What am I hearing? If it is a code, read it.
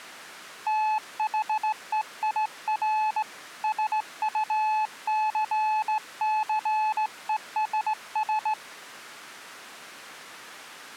Morse code, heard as a keyed tone, hand-sent with a straight key, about 17 wpm, 860 Hz. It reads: THEIR SUCCESS